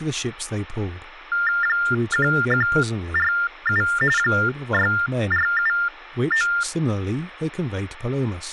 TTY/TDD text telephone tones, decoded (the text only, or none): 1147 6479